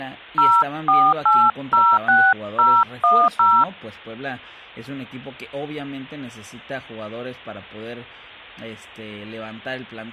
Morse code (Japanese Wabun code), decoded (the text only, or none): none